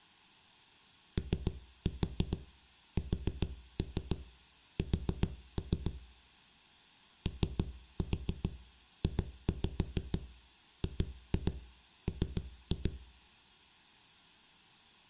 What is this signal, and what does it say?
Tap code, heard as knocks on a wall, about 7 knocks a second, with room echo. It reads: OSS OJGM